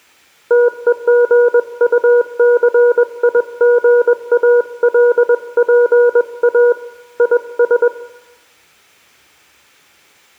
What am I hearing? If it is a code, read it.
Morse code, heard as a keyed tone, hand-sent with a paddle, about 21 wpm, 480 Hz, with room echo. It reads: TEGUCIGALPA IS